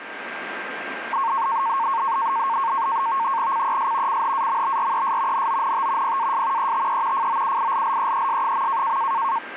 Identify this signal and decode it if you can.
NAVTEX (SITOR-B), 100 baud, 170 Hz shift, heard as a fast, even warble, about 1000 Hz centre, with radio static and a steady whistle near 1590 Hz. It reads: CES CHAMBRES NONT PAS ETE FOUILLEES.